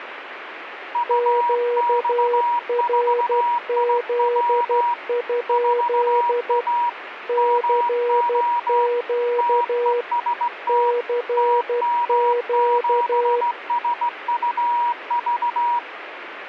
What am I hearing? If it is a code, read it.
Morse code, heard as two keyed tones, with radio static. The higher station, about 17 wpm, 960 Hz: UX4IW 4A MO TEST TM7SUV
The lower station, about 12 wpm, 480 Hz: QRZ? CQ CQ